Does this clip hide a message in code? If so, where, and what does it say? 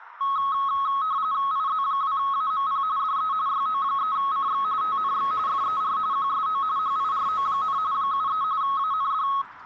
Yes: RTTY (45.45 baud, 170 Hz shift) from 0.2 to 9.4 s, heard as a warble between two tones, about 1190 Hz centre, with radio static and street noise. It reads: IZ2AMP DE YO3CX TNX FER QSO HIRO, 73 AND